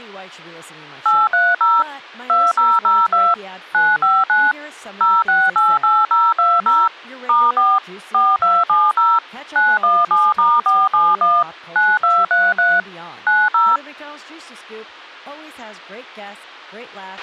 DTMF, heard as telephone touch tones, dialled by machine, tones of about 220 ms, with a squelch burst at the end and speech in English. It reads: 830 2002 959 0688020 *4 4270 917*471 9233 90